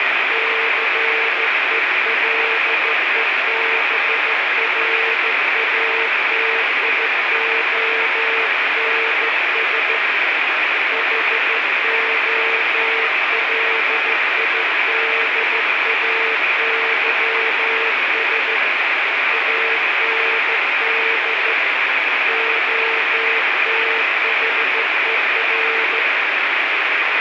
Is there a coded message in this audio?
Yes: Morse code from 0.3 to 26.1 s, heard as a keyed tone, hand-sent with a straight key, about 14 wpm, 450 Hz, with heavy radio static. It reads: CELEBRATIONS HOLIDAYS AND OTHER